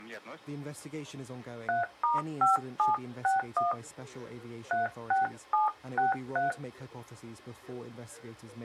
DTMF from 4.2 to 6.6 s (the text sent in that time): 36763